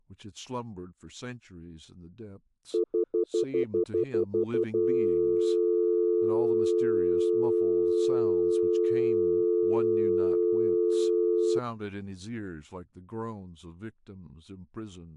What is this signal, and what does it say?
Telephone call progress tone (North American plan), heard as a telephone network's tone, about 350, 440 Hz, 0.1 s on and 0.1 s off, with speech in English. Stutter dial tone.